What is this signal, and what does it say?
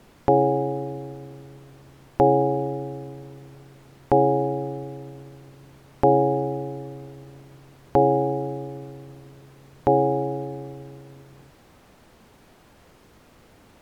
Clock strike, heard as a bell. 6. Six o'clock.